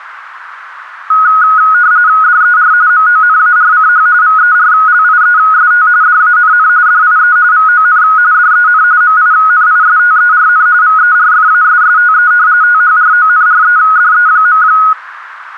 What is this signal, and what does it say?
RTTY (45.45 baud, 170 Hz shift), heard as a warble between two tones, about 1360 Hz centre, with radio static. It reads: DER MONARCH VERLIEST DANN DIE VON DEN MINISTERN VERFASSTE THRONREDE.